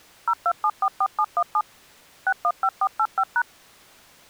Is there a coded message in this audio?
Yes: DTMF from 0.3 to 3.4 s, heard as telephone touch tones, dialled by machine, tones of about 60 ms. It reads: 02744717 615485#